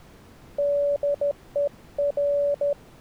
Morse code, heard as a keyed tone, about 13 wpm, 570 Hz. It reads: DER